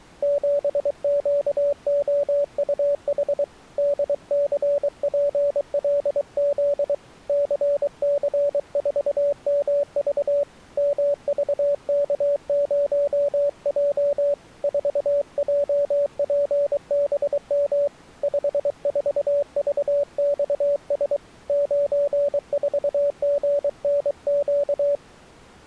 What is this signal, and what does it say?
Morse code, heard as a keyed tone, hand-sent with a paddle, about 23 wpm, 570 Hz. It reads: 7QOUH DCPLZ CC4MV MVK0J 4JPBM 54VXS 94GNQ